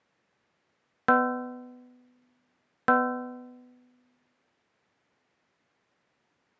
Clock strike, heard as a bell. 2. Two o'clock.